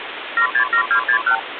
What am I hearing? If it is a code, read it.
Multi-frequency trunk signalling (R2, with the far end's replies), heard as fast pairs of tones, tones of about 90 ms, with phone line noise. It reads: 767261